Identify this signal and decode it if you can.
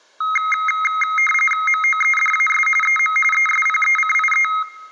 RTTY (45.45 baud, 850 Hz shift), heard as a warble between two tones, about 1700 Hz centre. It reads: MOEDAS EM ESPECIE